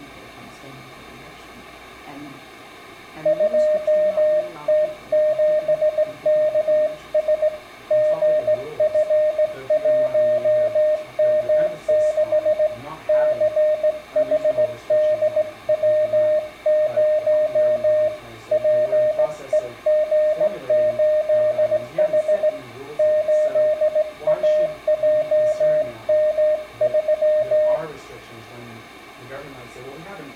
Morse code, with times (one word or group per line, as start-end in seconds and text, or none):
3.3-7.5 2T7KS
7.9-12.7 GF1M6
13.1-18.1 CHDW0
18.5-22.5 PEG8H
23.0-27.8 8AJM3